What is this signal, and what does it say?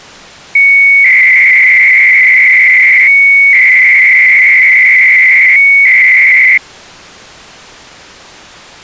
300-baud modem data (Bell 103 tones), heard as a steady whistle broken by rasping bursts, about 300 baud, 200 Hz shift.